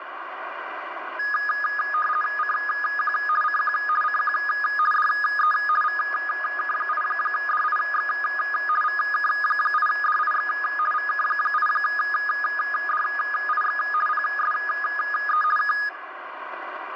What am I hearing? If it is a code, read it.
RTTY (50 baud, 450 Hz shift), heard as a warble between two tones, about 1460 Hz centre, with radio static. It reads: CQ CQ CQ DE VK8DIX VK8DIX VK8DIX PSE K